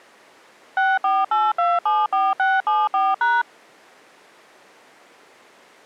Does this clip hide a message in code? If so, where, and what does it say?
Yes: DTMF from 0.8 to 3.4 s, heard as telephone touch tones, dialled by machine, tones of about 210 ms. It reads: 648274674#